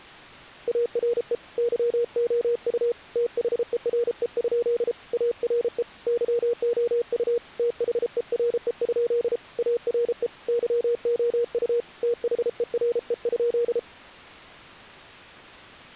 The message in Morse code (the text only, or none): ARE YOU THERE? ARE YOU THERE? ARE YOU THERE?